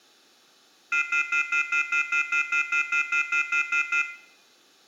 Telephone call progress tone (North American plan), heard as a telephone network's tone, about 1400, 2050, 2450, 2600 Hz, 0.1 s on and 0.1 s off, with room echo. Off-hook warning tone.